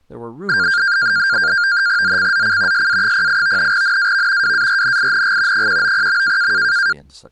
NAVTEX (SITOR-B), 100 baud, 170 Hz shift, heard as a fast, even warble, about 1500 Hz centre, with speech in English. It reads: ZCZC SA08 NAV WARNING 190.